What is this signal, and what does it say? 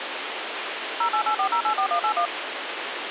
DTMF, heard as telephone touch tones, dialled by machine, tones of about 90 ms, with radio hiss. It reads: 0884084181